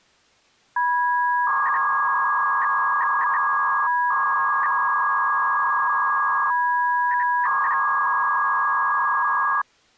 300-baud modem data (V.21 tones), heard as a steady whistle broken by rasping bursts, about 300 baud, 200 Hz shift.